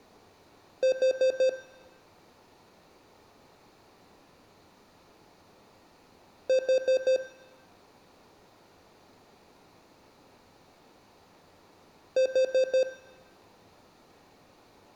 Alarm pattern, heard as an alarm's beeps, played three times, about 520 Hz, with room echo. Temporal four. Carbon monoxide.